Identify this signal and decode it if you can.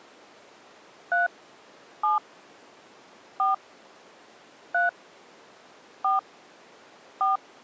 DTMF, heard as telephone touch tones, dialled by hand, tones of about 150 ms. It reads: 3 7 4 3 4 4